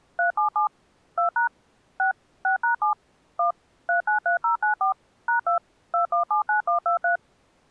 DTMF, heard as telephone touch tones, dialled by machine, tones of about 120 ms. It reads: 377 2# 6 6#7 1 393094 #2 2179123